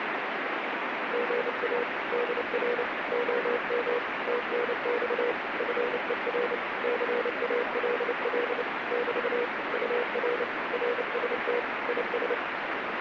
Morse code, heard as a keyed tone, machine-sent, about 29 wpm, 480 Hz, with heavy radio static. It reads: GA DR OM TNX FER CALL <BT> UR RST IS